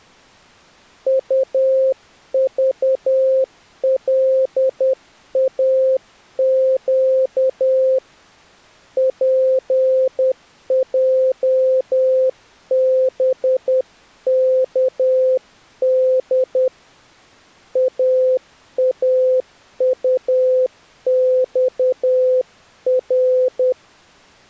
Morse code, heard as a keyed tone, hand-sent with a paddle, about 10 wpm, 520 Hz. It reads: UVLAQ PJBKD AAUXR